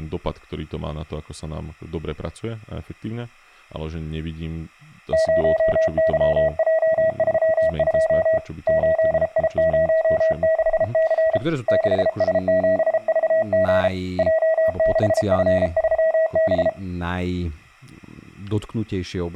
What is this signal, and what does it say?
Morse code, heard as a keyed tone, hand-sent with a paddle, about 33 wpm, 640 Hz, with speech in Slovak. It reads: 0YJ32 8I06C 6S7VG J6F3B